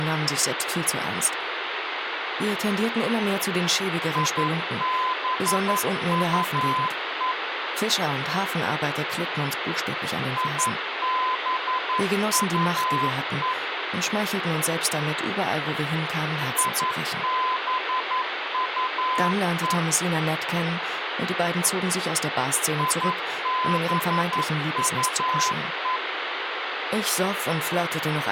Morse code, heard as a keyed tone, machine-sent, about 11 wpm, 1020 Hz, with radio hiss. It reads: IBUE IBUE IBUE IBUE